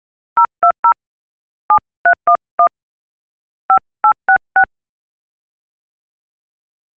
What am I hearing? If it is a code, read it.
DTMF, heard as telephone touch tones, dialled by hand, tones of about 80 ms. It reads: 020 7311 5866